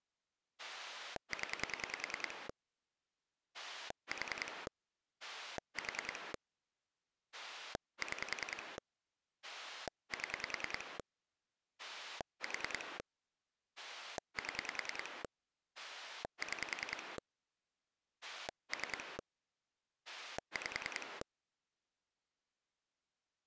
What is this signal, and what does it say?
Pulse dialling, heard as a rotary dial, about 10 pulses a second. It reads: 0 4 4 6 7 4 7 6 3 5